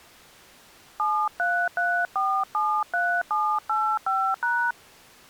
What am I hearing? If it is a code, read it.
DTMF, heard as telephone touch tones, dialled by hand, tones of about 280 ms. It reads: 733473785#